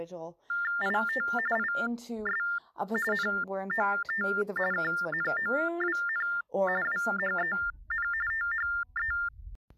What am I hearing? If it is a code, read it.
TTY/TDD text telephone tones (45.45 baud Baudot), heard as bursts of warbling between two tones, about 400 Hz shift, 1600 Hz centre, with speech in English. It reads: IT IS NOT KNOWN WHEN THE